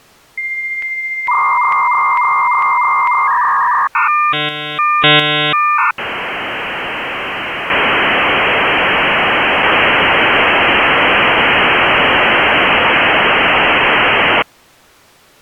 Dial-up modem handshake (V.34 or later), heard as a whistle, warbles, then hiss.